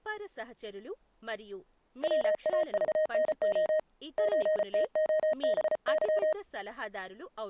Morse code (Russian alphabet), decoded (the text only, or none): ВАЖНО ЧТОБЫ